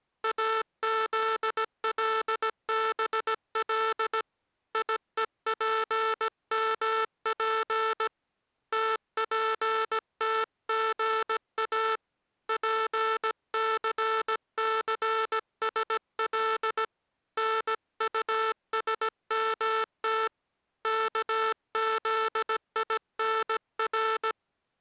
Morse code (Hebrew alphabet), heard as a buzzer, hand-sent with a paddle, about 17 wpm. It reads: אזלבל יופמף תפתגא פססשל נטשמת כזינר